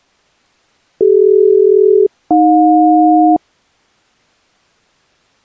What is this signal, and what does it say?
Aircraft SELCAL, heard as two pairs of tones. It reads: CD-AJ